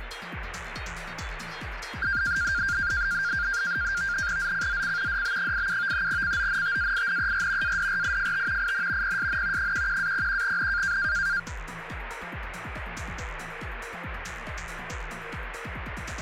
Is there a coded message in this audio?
Yes: NAVTEX (SITOR-B), 100 baud, 170 Hz shift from 2.0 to 11.4 s, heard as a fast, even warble, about 1500 Hz centre, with radio static. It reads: ZCZC DB87 CONTAINER ADRIFT IN PSN 11-01N